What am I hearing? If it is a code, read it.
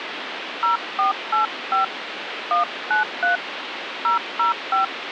DTMF, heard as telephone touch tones, dialled by hand, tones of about 130 ms, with phone line noise. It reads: 0485 193 005